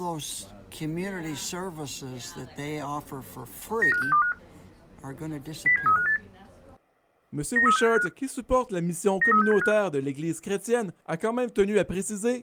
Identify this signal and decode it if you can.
Five-tone selective call (CCIR), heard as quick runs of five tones, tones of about 100 ms. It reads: 95625 07358 93675 93675